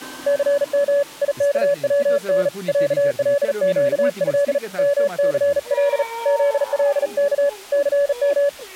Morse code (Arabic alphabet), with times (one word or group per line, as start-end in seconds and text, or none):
0.3-1.0 ثم
1.2-2.5 يكون
2.7-4.6 علقه
4.8-6.0 مثل
6.3-7.5 ذلك
7.7-8.5 ثم